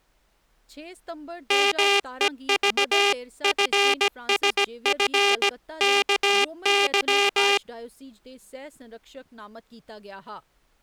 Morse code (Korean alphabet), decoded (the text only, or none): 말년에